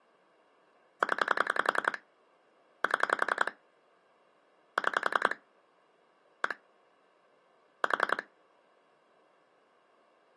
Pulse dialling, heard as clicks on a phone line, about 11 pulses a second. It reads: 0 7 6 1 4